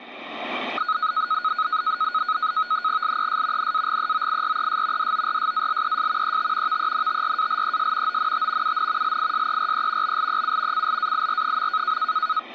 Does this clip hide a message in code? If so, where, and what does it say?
Yes: NAVTEX (SITOR-B), 100 baud, 170 Hz shift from 0.8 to 12.4 s, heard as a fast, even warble, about 1360 Hz centre. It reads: LES NAGEOIRES DORSALES ET VENTRALES ONT UN LISERE BLEU CLAIR.